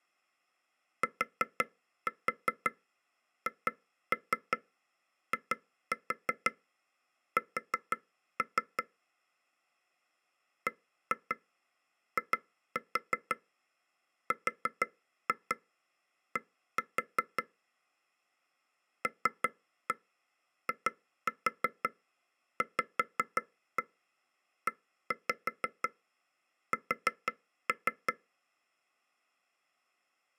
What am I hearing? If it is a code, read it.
Tap code, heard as taps on a table, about 5 knocks a second. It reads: THIS BIRD LIVES